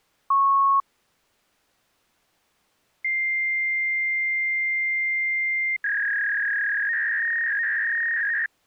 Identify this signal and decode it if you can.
Fax machine handshake, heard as a beep, a long tone and a warble.